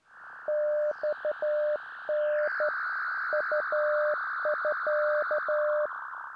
Morse code (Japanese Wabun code), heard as a keyed tone, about 12 wpm, 600 Hz. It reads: マタ ウミ